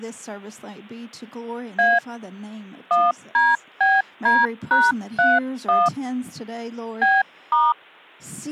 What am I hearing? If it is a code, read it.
DTMF, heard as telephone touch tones, dialled by hand, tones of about 200 ms. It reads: A 1DBD#31 B*